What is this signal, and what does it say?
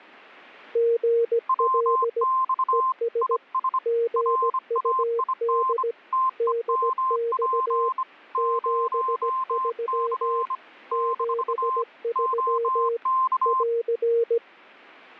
Morse code, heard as two keyed tones. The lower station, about 17 wpm, 460 Hz: GL ES GUD DX 73 73 <AR>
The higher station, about 25 wpm, 1040 Hz: WX IS RAIN TEMP 0C - OK